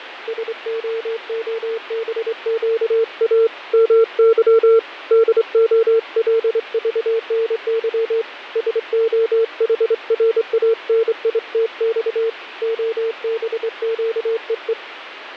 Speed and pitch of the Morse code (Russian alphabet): 25 wpm, 450 Hz

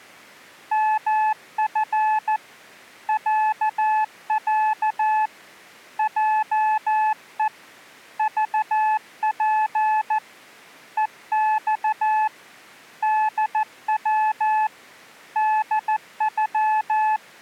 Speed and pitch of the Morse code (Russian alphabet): 14 wpm, 860 Hz

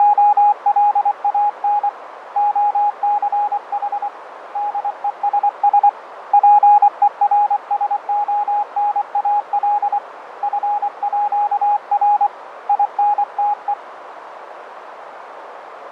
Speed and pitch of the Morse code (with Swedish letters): 24 wpm, 830 Hz

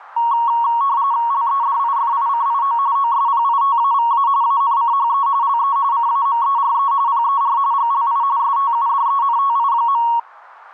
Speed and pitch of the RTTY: 45.45 baud, 170 Hz shift, 1020 Hz centre

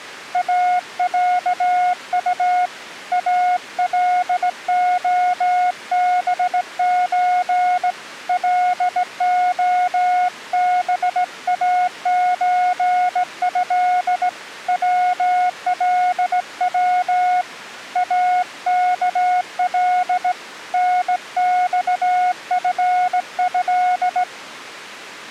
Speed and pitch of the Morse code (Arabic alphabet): 17 wpm, 720 Hz

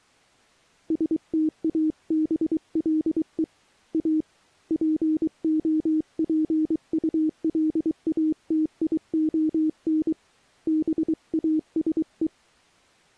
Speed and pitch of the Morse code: 23 wpm, 310 Hz

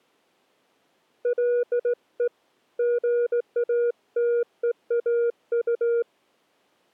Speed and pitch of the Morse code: 17 wpm, 480 Hz

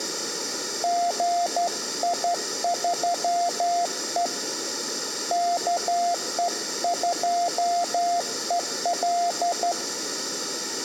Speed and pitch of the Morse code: 12 wpm, 700 Hz

